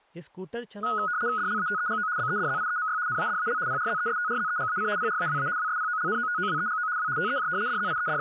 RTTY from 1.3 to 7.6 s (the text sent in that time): DLATEGO BEDZIEMY NADAL PRZESTRZEGAC PRAWA WSPOLNOTOWEGO W TEJ